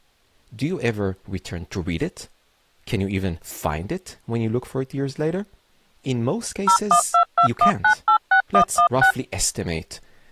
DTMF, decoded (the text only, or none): 01221986116